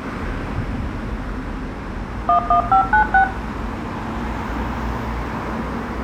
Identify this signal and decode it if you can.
DTMF, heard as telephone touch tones, dialled by machine, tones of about 100 ms, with room echo and street noise. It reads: 11596